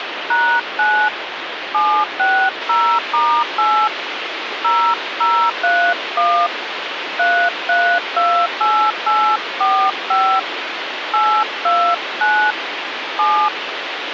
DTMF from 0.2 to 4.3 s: #9 760*8

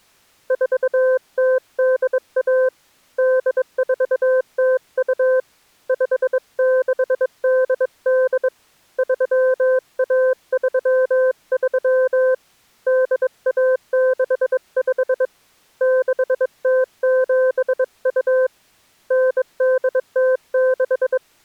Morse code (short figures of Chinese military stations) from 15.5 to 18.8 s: 6072

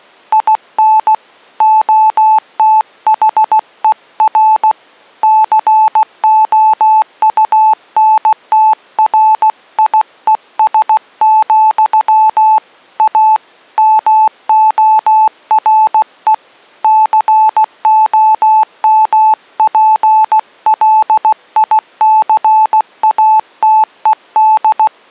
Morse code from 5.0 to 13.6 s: COUNTRIES, A

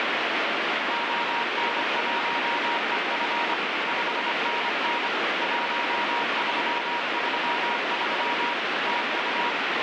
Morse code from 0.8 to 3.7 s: ON1EF

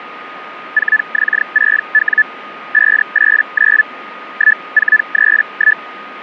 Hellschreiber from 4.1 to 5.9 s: 1431

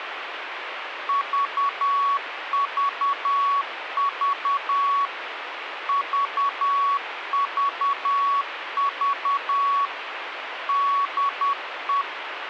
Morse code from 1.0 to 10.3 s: VVV VVV

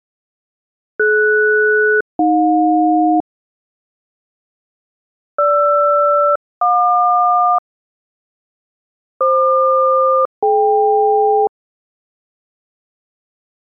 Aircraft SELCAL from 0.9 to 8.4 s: DS-AJ GR-JQ

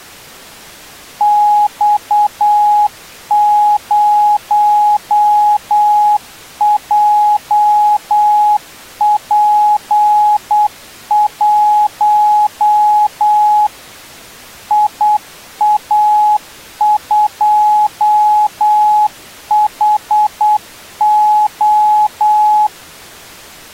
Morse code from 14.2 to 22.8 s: IA2HO

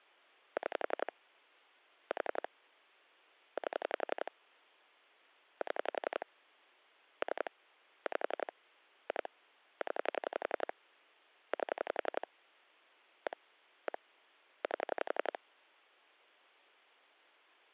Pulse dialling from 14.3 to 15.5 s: 8

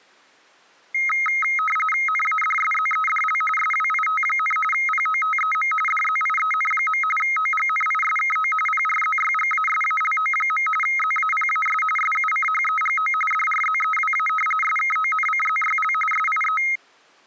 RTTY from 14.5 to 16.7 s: SKONCZYL SIE

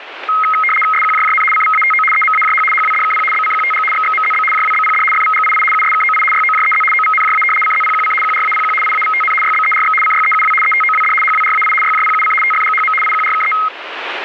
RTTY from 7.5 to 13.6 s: CZPQC QRAPQ IAVTN YBERX CYEUW ETOWD HWRAI YJPUC TFGHM IQRKE

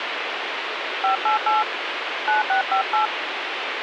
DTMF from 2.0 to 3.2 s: 9658

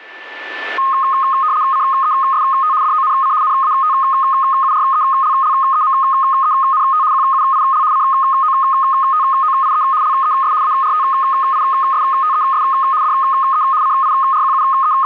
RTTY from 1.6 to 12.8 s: CEST DONC NATURELLEMENT QUIL COTOIE LES ARTISTES

